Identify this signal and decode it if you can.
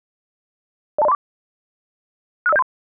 Five-tone selective call (EIA), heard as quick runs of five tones, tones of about 30 ms. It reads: 02034 65073